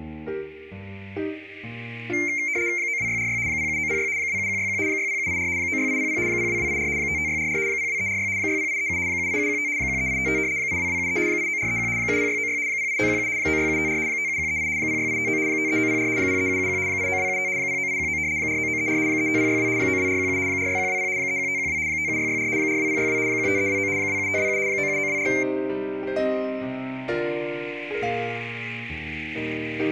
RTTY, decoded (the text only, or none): 92646 07906 27161 60784 96800 02284 55644 02346 60837 78715 13855 82273 89431 70696 08917 96754 57138 06859 53904 03771 89275 09819 49934 35062 92417 46120 31512 57664 42062 15329 27527 97924